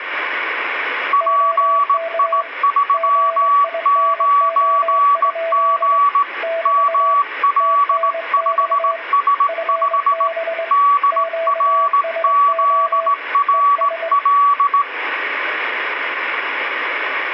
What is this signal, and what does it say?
Morse code, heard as two keyed tones, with radio static and room echo. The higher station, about 18 wpm, 1140 Hz: PI39G ML5S5 DRZRL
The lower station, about 22 wpm, 660 Hz: OK GINO? <BT> TNX FB QSO ES